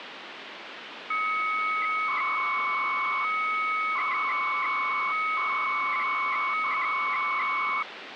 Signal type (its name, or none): 300-baud modem data